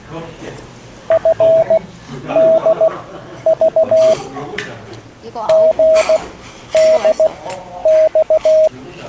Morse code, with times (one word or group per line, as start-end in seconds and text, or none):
1.1-4.1 FDV
5.5-8.7 GDX